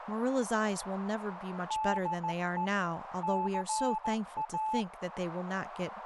Morse code (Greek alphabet), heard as a keyed tone, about 15 wpm, 870 Hz, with radio static and speech in English. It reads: ΔΕ ΘΑ